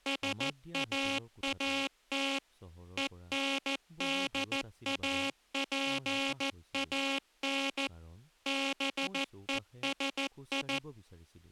Morse code, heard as a buzzer, machine-sent, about 14 wpm, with speech in Assamese. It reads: SAAT ENDAPAN BESI